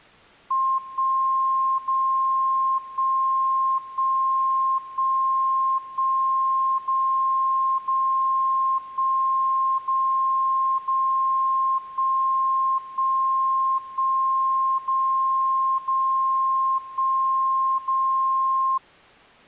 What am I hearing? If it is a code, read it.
Radio time signal (DCF77), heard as a tone whose level steps once a second, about 1060 Hz. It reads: 1 0 1 1 1 1 0 0 1 0 0 1 1 1 0 0 1 0